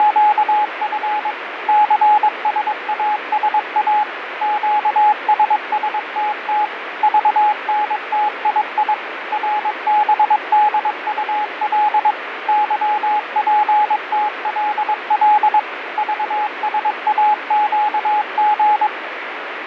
Morse code, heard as a keyed tone, machine-sent, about 22 wpm, 840 Hz, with radio static. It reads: … CSASA QSSTT VNTII RBDUL YPTLL VSAQG